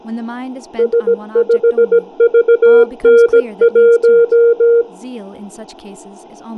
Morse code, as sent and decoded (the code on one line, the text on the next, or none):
... ..... ...- -. .----
S5VN1